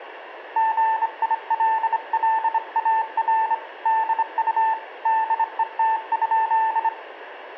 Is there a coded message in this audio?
Yes: Morse code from 0.5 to 6.9 s, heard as a keyed tone, hand-sent with a straight key, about 25 wpm, 890 Hz, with radio static and room echo. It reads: GILLAR DU DET?